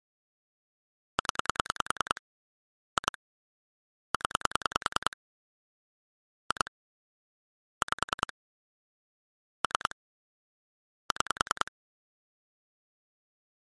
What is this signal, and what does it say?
Pulse dialling, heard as clicks on a phone line, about 10 pulses a second. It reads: 0 2 0 2 5 3 6